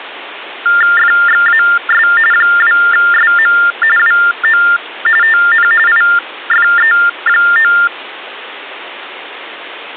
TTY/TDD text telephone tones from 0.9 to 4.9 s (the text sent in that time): FXAS 2SM WO